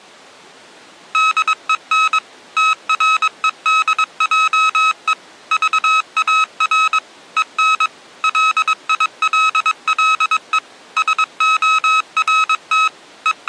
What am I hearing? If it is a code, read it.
Morse code, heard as electronic beeps, machine-sent, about 22 wpm, 1280 Hz. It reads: DEN TREDJE VAR EN LILLE SORT …